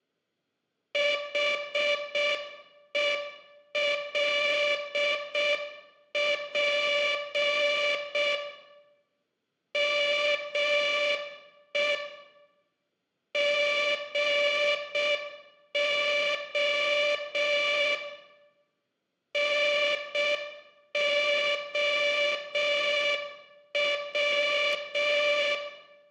Morse code, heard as a buzzer, machine-sent, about 6 wpm, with room echo. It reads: HELP ME GO NOW